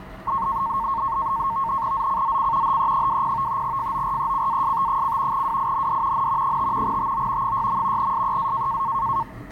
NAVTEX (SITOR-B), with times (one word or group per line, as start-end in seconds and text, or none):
1.9-2.8 ZCZC
2.6-3.6 HE20
3.6-5.4 FORECAST:
5.3-6.3 WIND
6.1-6.6 N
6.4-7.0 5
6.8-7.5 TO
7.4-8.1 6.
8.0-8.8 SEA